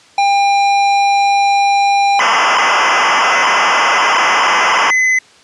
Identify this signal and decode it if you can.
ZX Spectrum tape loading, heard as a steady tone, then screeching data.